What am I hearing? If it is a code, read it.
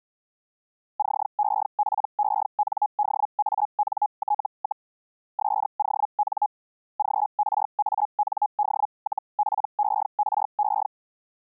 Hellschreiber (Feld-Hell, 122.5 baud), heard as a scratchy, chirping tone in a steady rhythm, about 840 Hz. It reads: CEPENDANT, SON GRAND-PERE